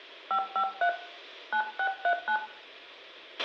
DTMF, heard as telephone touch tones, dialled by hand, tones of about 80 ms, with a squelch burst at the end and room echo. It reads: 553 9639